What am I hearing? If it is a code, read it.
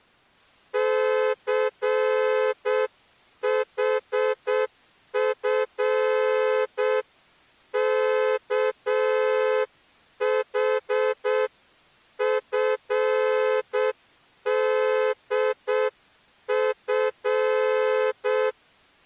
Morse code (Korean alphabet), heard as a horn, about 7 wpm. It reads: 춘우는